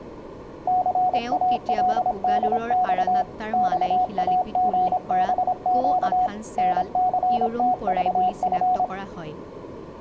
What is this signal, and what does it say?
Morse code, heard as a keyed tone, machine-sent, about 26 wpm, 730 Hz, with speech in Assamese. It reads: CALDX XAGBQ NCTVF